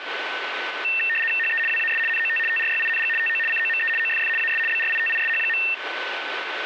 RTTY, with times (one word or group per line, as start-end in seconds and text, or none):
1.4-1.6 HE
1.7-2.0 WAS
2.1-2.4 NOT
2.5-3.1 TRYING
3.2-3.4 TO
3.5-3.9 COME
4.0-4.3 OFF
4.4-4.6 AS
4.7-5.6 BRITISH.